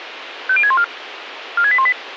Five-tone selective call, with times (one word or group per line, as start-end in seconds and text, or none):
0.5-0.8 50614
1.6-1.9 46818